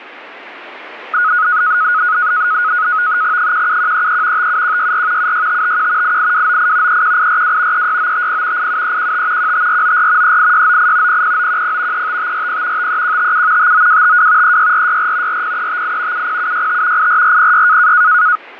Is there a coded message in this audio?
Yes: NAVTEX (SITOR-B), 100 baud, 170 Hz shift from 1.1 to 18.4 s, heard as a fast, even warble, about 1360 Hz centre, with radio static. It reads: 17133 57164 76551 88298 31842 36950 87315 15494 38698 00910 35540 53157 59252 36464 40358 70765 84406